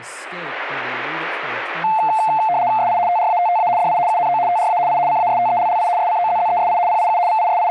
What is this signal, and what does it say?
RTTY (75 baud, 170 Hz shift), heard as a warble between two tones, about 790 Hz centre, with speech in English. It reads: SI TRATTA DI UNO TRA I CASTELLI SCOZZESI PIU …